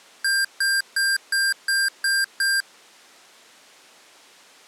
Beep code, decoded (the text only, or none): 7 short